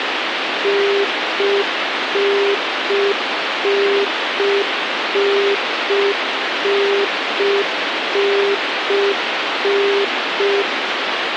Telephone call progress tone (UK plan), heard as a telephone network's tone, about 400 Hz, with phone line noise. Congestion tone.